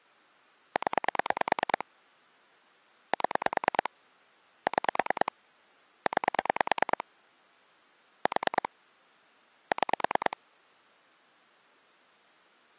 Pulse dialling, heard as clicks on a phone line, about 9 pulses a second. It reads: 0 7 6 9 4 6